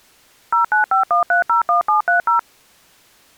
DTMF, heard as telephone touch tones, dialled by machine, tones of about 120 ms. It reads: 0951301730